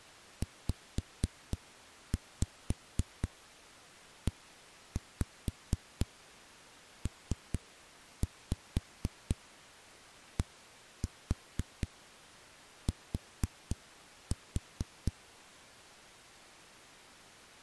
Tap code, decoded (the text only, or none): ZEPDT